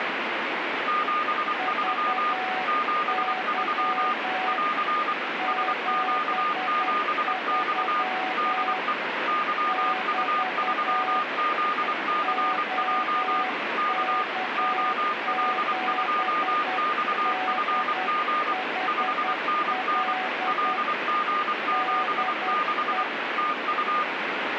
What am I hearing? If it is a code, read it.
Morse code, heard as two keyed tones, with radio static. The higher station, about 24 wpm, 1220 Hz: 73 73 <AR> SQ7X DE YU3ZCJ K OL2XFG 5NN LG76 TU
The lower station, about 10 wpm, 750 Hz: VY 73 <BT> OK7DHL DE